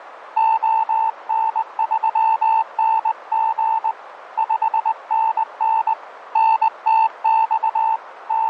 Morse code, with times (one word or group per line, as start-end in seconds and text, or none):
0.4-3.9 ON3NG
4.4-5.9 5NN
6.4-8.0 NTX
8.3-8.5 …